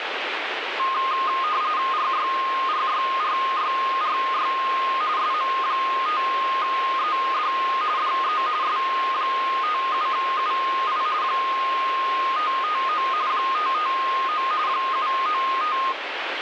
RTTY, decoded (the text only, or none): RYRYRYRY SM5ED DE S57UI 559 559 795